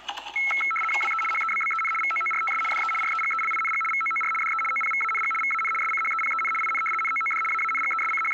RTTY (75 baud, 850 Hz shift), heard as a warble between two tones, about 1750 Hz centre, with the noise of a cafe. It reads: WE HEBBEN VOORTS DE REGELING VOOR DE OPVANG VAN SCHEPEN IN NOOD …